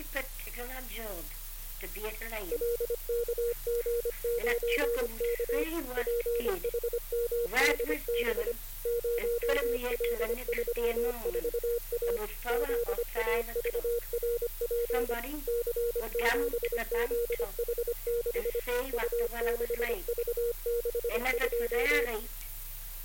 Morse code, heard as a keyed tone, machine-sent, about 25 wpm, 470 Hz. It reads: LKG9K PHMDB 0L34A ZAVRP C7ZH6 U6V62